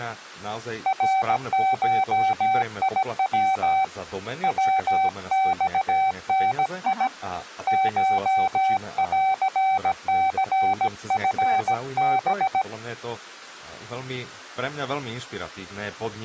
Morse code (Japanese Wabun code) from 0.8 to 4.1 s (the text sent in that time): ナゴヤ